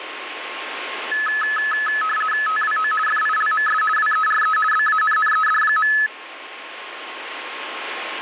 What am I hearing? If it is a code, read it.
RTTY (50 baud, 450 Hz shift), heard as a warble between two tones, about 1500 Hz centre, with radio static and a steady whistle near 1070 Hz. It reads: TWO FILMS WERE BANNED.